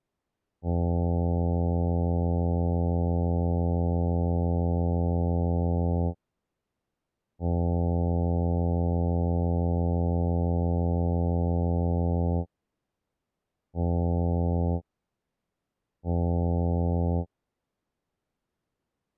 Ship horn signal, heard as a ship's horn, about 90 Hz. 2 long, 2 short. At sea: I intend to overtake on your port side.